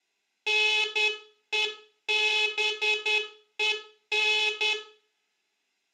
Morse code, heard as a buzzer, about 10 wpm, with room echo. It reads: NEBEN